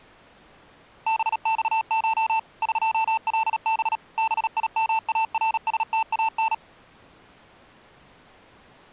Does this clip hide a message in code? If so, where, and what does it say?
Yes: Morse code (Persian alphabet) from 1.0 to 6.6 s, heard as electronic beeps, machine-sent, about 37 wpm, 890 Hz. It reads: بخش قلب بیمارستان